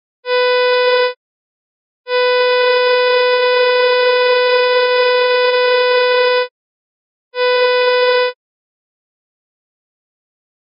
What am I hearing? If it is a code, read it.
Ship horn signal, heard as a ship's horn, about 500 Hz. 1 short, 1 long, 1 short. At sea: a vessel at anchor warns of its position.